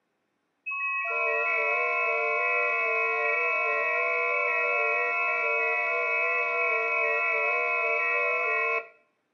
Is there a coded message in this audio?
Yes: FT8 (several signals at once) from 0.7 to 8.8 s, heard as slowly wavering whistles, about 6.25 baud, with room echo.